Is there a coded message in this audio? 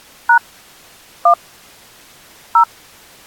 Yes: DTMF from 0.3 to 2.6 s, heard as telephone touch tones, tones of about 90 ms. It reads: # 1 0